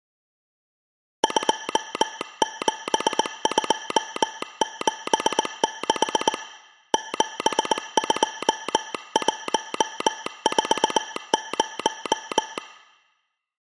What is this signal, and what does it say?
Morse code, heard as a telegraph sounder, hand-sent with a paddle, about 19 wpm, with room echo. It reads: 27276 72140